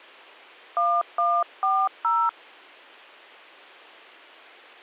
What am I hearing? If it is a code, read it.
DTMF, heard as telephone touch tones, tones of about 250 ms. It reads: 1140